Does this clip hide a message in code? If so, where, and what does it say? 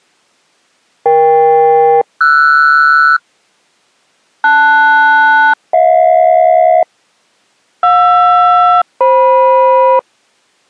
Yes: aircraft SELCAL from 1.1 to 10.0 s, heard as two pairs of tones. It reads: EK-RS LS-HJ JR-FM